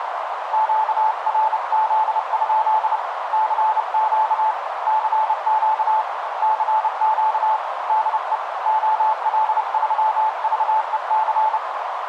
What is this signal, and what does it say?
Morse code, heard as a keyed tone, hand-sent with a bug key, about 30 wpm, 870 Hz, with radio static and a narrow filter. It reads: QRZ? CQ CQ CQ DE OL3VEC